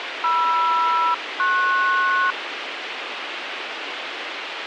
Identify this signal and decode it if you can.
Aircraft SELCAL, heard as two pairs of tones, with radio hiss. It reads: MR-PS